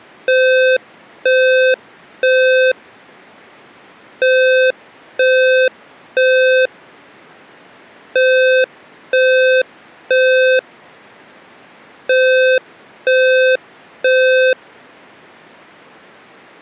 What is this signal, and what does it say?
Alarm pattern, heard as an alarm's beeps, played four times, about 520 Hz. Temporal three. Smoke or fire, evacuate.